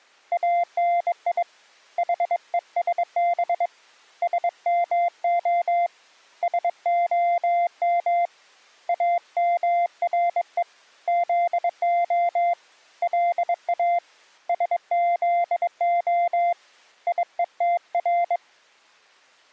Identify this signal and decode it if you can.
Morse code (Hebrew alphabet), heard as a keyed tone, hand-sent with a bug key, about 22 wpm, 690 Hz. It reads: אני חושב שמה שהם אמרו זה לא שזה יותר